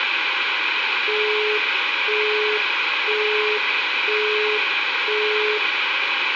Telephone call progress tone (single-tone plan, as in Europe, Japan and elsewhere), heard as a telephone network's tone, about 420 Hz, 0.5 s on and 0.5 s off, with phone line noise and room echo. Busy tone.